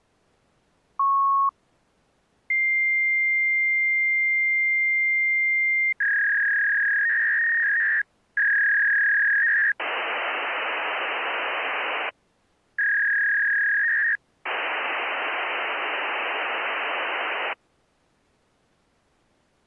Fax machine handshake, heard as a beep, a long tone, a warble and hiss.